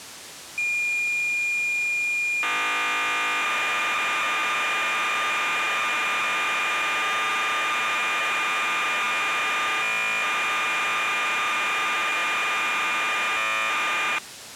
Cassette data (Kansas City type), 1200 baud, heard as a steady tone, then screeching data.